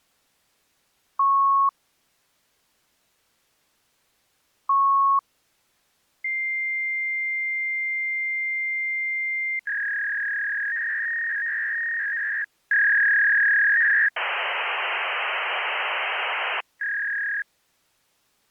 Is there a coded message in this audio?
Yes: fax machine handshake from 1.2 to 17.4 s, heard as beeps, a long tone, a warble and hiss.